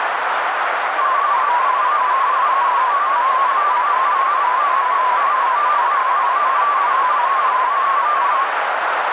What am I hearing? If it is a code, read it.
Multi-tone FSK (Olivia or MFSK type), about 250 Hz wide, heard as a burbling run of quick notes, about 31.25 baud, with heavy radio static and a narrow filter.